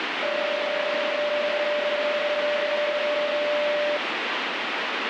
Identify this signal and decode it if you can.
PSK31 (31.25 baud), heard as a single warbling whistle, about 590 Hz, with radio static.